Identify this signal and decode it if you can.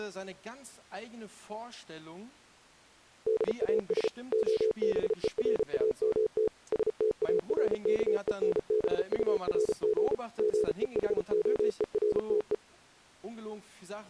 Morse code, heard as a keyed tone, machine-sent, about 34 wpm, 430 Hz. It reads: DAS OBERAMT STARKENBURG GEHOERTE